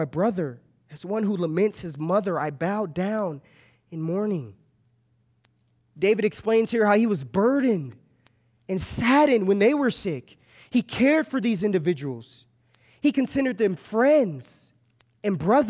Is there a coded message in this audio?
No, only speech in English.